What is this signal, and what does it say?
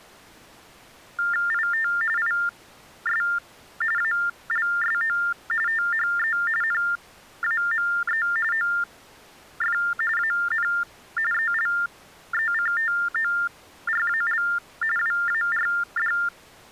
TTY/TDD text telephone tones (45.45 baud Baudot), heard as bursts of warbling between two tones, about 400 Hz shift, 1600 Hz centre. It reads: IT IS ALSO THE NAME OF AN ELECTORAL WARD